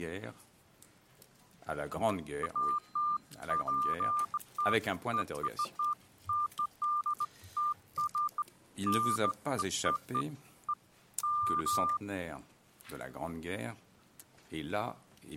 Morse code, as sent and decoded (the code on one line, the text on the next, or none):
none